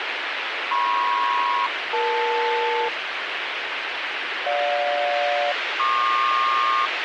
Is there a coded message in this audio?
Yes: aircraft SELCAL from 0.7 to 6.9 s, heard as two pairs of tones, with radio hiss. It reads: MP-EL GJ-PQ